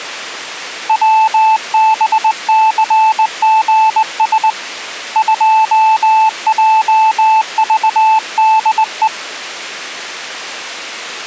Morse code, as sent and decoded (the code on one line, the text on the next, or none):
.-- -... -.-. --. ... / ..--- .--- ...- -.. .
WBCGS 2JVDE